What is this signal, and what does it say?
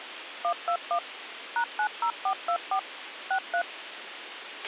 DTMF, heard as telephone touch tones, dialled by machine, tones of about 80 ms, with radio hiss and a squelch burst at the end. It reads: 121 #90424 63